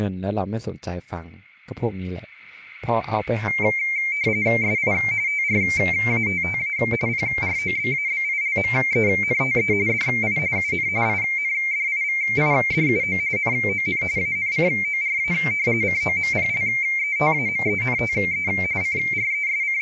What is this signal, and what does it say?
RTTY (45.45 baud, 170 Hz shift), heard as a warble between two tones, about 2200 Hz centre, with speech in Thai. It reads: SI TRATTA PROBABILMENTE DI UN INDIVIDUO NON ANCORA COMPLETAMENTE …